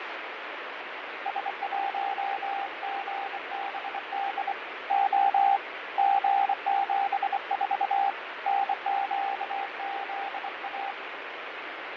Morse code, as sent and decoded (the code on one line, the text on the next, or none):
... .---- --. -... -.. / --- / --. --... ....- / -. --.- --.. .-
S1GBD O G74 NQZA